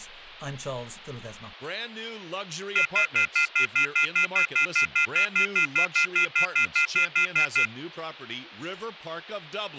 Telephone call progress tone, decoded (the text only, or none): off-hook warning tone